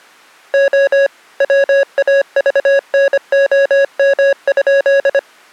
Morse code (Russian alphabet), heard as electronic beeps, machine-sent, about 25 wpm, 550 Hz. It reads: О ВАЖНОМ?